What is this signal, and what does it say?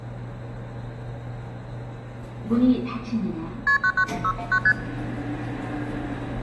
Multi-frequency trunk signalling (R1, as on North American trunks), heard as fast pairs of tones, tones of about 70 ms, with the noise inside a lift. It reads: KP 991619 ST